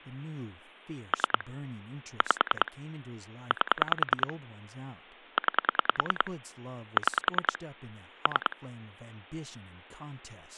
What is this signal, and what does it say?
Pulse dialling, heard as clicks on a phone line, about 10 pulses a second, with speech in English. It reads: 3 5 8 9 6 3